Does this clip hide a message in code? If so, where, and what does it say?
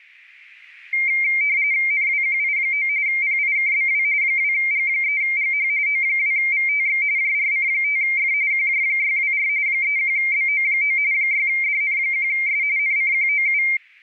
Yes: RTTY (45.45 baud, 170 Hz shift) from 0.9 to 13.8 s, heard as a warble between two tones, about 2200 Hz centre. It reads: NWQI9 PIKBW 2G3GH O2VTX JRC5F QJ624 31BO9 6DN1S NCQOU